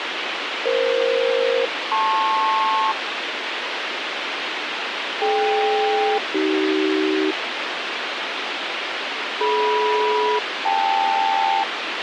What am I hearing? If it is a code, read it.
Aircraft SELCAL, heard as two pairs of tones, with radio hiss. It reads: EF-LP DK-AC DM-KL